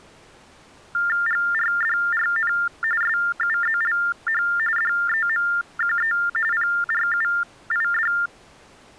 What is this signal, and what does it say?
TTY/TDD text telephone tones (45.45 baud Baudot), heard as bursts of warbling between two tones, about 400 Hz shift, 1600 Hz centre. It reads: GRDRN SUZLH DEMQE PRUID